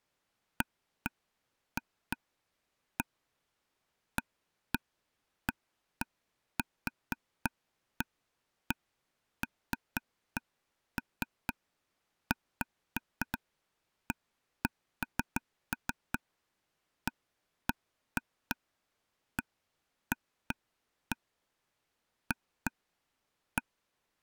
Irregular taps on a table. There is no code.